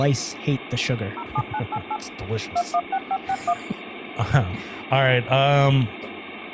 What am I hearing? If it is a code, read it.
DTMF, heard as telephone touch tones, dialled by machine, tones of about 60 ms, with phone line noise and speech in English. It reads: 07988 216561